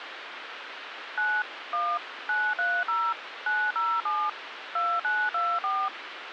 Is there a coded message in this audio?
Yes: DTMF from 1.2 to 5.9 s, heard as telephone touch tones, dialled by machine, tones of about 240 ms, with phone line noise. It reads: 9 1 930 907 2924